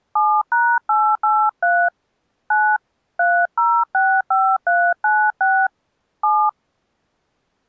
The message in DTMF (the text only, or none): 7#883 9 3065396 7